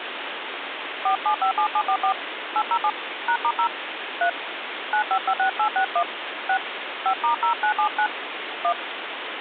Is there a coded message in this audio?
Yes: DTMF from 1.1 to 8.7 s, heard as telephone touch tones, dialled by hand, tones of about 90 ms, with phone line noise. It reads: 4757744 807 #*0 3 9556861 6 5*0979 1